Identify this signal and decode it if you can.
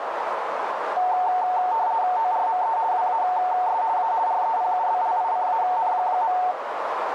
RTTY (50 baud, 170 Hz shift), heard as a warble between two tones, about 820 Hz centre, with radio static and a narrow filter. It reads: ORME WAS A REPUBLICAN.